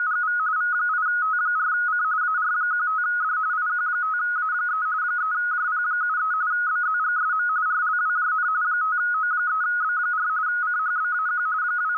RTTY (45.45 baud, 170 Hz shift), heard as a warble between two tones, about 1360 Hz centre, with radio static. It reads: … V8T4C AR15D IQ5A3 3JP73 BZGSM RLWJN 5O3B4 CHBAQ …